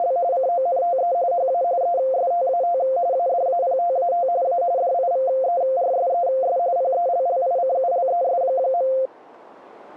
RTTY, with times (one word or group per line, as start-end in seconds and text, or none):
0.0-0.2 …
0.3-1.1 CONTE
1.3-1.6 HA
1.8-2.8 ESTAT
3.1-4.3 ADAPTAT
4.4-4.6 A
4.8-6.6 DIVERSES
6.8-8.9 PELLICULES.